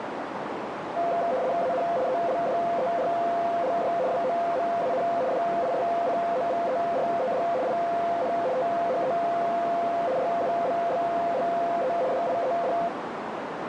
RTTY (75 baud, 170 Hz shift), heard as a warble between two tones, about 600 Hz centre, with radio static and a narrow filter. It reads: AN ELDERLY WOMAN DISCOVERED IN THE RUBBLE DIED